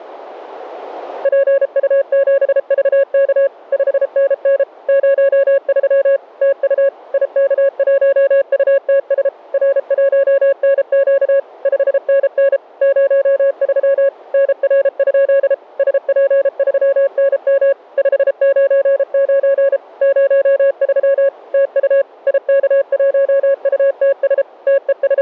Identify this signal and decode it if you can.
Morse code, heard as a keyed tone, machine-sent, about 33 wpm, 550 Hz. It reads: PU7VK 5NN 03 TU IK1UTS R1NQ 5NN 03 NR? SP3NM 599 03 TU IK1UTS …